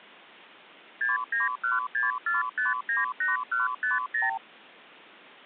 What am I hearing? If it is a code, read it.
Multi-frequency trunk signalling (R2, with the far end's replies), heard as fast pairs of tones, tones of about 160 ms. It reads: 69164598150